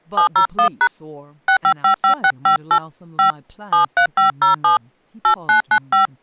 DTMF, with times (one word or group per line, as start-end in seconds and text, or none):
0.2-0.9 701#
1.5-2.8 6555658
3.2-3.3 5
3.7-4.8 73507
5.2-6.1 8995